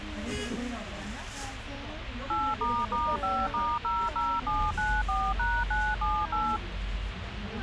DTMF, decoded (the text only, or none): 8**5*00794#978